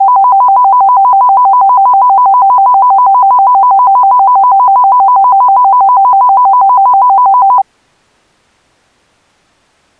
A tone that alternates evenly between two pitches. There is no code.